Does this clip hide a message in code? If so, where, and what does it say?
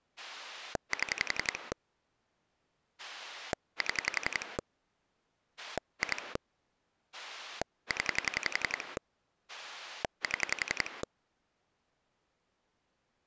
Yes: pulse dialling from 0.2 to 11.0 s, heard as a rotary dial, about 11 pulses a second. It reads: 7 7 2 0 7